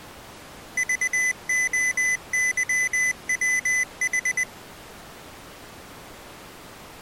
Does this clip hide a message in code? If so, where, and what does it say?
Yes: Morse code (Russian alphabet) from 0.7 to 4.5 s, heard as a high beeper, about 20 wpm, 2000 Hz. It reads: ЖОЫВХ